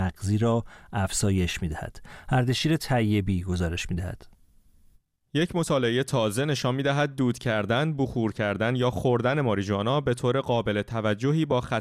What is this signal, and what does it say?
Speech in Persian. There is no code.